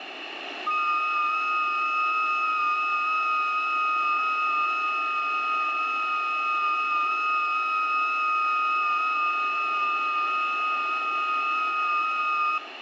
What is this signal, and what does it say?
FT8 (several signals at once), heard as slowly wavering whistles, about 6.25 baud, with radio static and room echo.